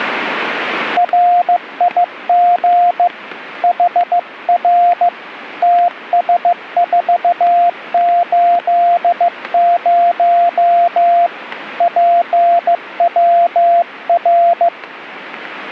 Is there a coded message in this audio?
Yes: Morse code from 0.9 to 14.7 s, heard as a keyed tone, hand-sent with a bug key, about 15 wpm, 700 Hz, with radio static and static crashes. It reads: RIG HR TS480 PWR